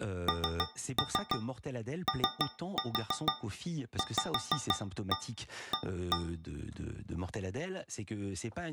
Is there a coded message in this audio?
Yes: tap code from 0.3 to 6.4 s, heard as taps on a metal pipe, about 6 knocks a second, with room echo and speech in French. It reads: NOVA